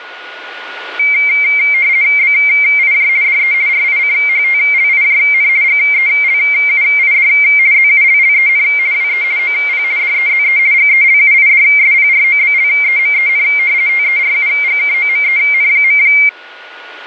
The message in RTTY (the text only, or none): BIJ DE RICHTLIJN GELUID ZULLEN WE OP DEZE GELUIDSPROBLEMEN TERUGKOMEN.